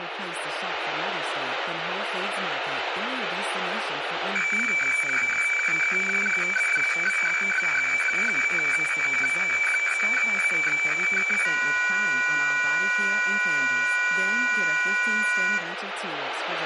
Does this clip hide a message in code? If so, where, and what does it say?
Yes: weather fax (radiofax), 120 lines a minute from 4.4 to 15.6 s, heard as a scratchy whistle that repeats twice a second, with radio static, room echo and speech in Filipino.